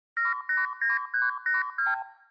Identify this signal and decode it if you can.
Multi-frequency trunk signalling (R2, with the far end's replies), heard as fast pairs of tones, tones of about 160 ms. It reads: 789382